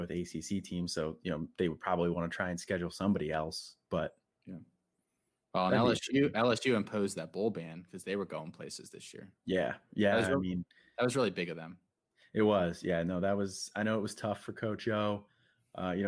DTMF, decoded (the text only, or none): none